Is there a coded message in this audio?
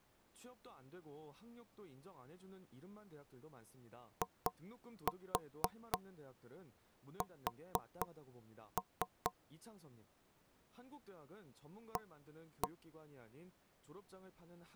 Yes: tap code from 4.2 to 12.7 s, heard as knocks on wood, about 4 knocks a second, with speech in Korean. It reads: IS A